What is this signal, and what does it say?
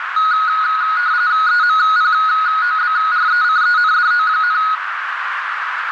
RTTY (45.45 baud, 170 Hz shift), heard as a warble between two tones, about 1360 Hz centre, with radio static and a narrow filter. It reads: EMPOBRECENDO,